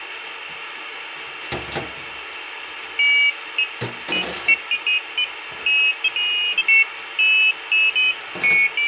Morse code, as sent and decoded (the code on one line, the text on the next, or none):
none